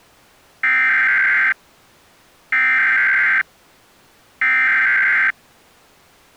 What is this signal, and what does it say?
Emergency Alert System (SAME) tones (header bursts), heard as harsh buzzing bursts, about 520.83 baud.